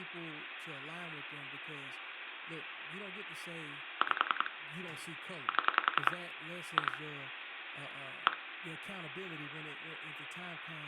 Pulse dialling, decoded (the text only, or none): 5 7 2 1